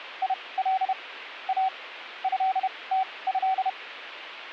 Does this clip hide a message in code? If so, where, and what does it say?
Yes: Morse code (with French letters) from 0.2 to 3.8 s, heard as a keyed tone, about 31 wpm, spaced as for 22 wpm, 760 Hz. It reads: IL A ÉTÉ